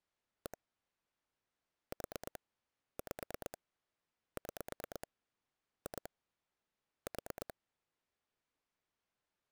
Pulse dialling, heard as clicks on a phone line, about 9 pulses a second. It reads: 1 4 5 6 2 4